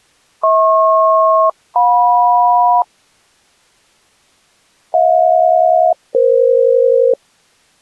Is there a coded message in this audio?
Yes: aircraft SELCAL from 0.4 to 7.1 s, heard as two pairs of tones. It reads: HP-JM HJ-EF